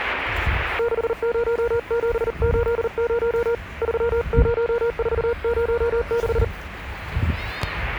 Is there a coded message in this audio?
Yes: Morse code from 0.7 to 6.5 s, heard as a keyed tone, hand-sent with a paddle, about 39 wpm, 480 Hz, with the noise of a residential street. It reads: 60780 30406